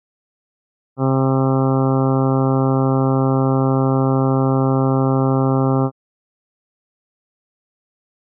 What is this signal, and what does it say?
Ship horn signal, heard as a ship's horn, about 130 Hz. 1 long. At sea: a vessel nearing a blind bend, or under power and making way in fog.